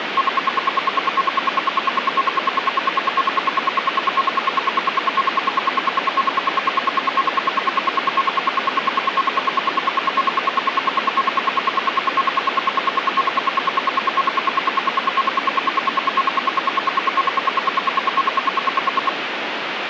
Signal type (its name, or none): radio time signal